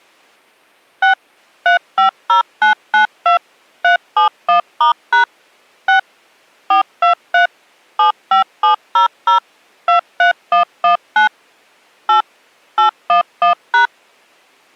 DTMF, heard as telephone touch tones, dialled by machine, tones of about 120 ms. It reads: 6 350992 371*# 6 423 75700 23119 8 811#